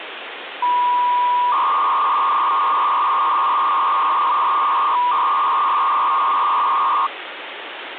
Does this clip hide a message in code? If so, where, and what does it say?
Yes: 300-baud modem data (V.21 tones) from 0.6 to 7.1 s, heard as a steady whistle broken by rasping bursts, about 300 baud, 200 Hz shift, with phone line noise.